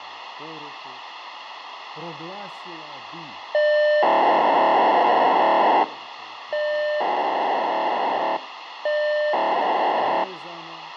POCSAG pager data (1200 baud), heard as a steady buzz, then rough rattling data, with radio hiss and speech in Croatian.